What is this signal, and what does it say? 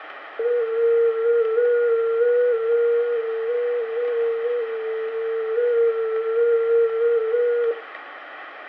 FT8 (one signal), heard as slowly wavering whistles, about 6.25 baud, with radio static.